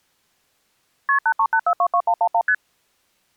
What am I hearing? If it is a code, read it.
Multi-frequency trunk signalling (R1, as on North American trunks), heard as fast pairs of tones, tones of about 70 ms. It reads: KP 838422111 ST